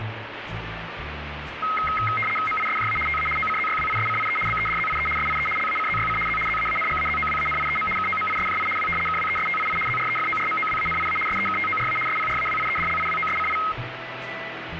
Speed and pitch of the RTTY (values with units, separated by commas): 75 baud, 850 Hz shift, 1700 Hz centre